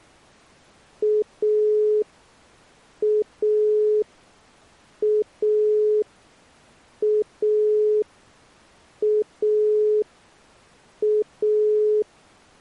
Telephone call progress tone (pulsed, as in Italy), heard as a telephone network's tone, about 420 Hz. Dial tone.